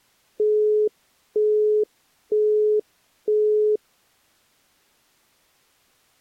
Telephone call progress tone (single-tone plan, as in Europe, Japan and elsewhere), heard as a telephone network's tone, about 420 Hz, 0.48 s on and 0.48 s off. Busy tone.